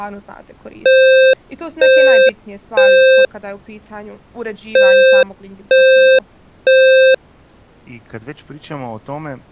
Alarm pattern, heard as an alarm's beeps, played twice, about 520 Hz, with speech in Croatian. Temporal three. Smoke or fire, evacuate.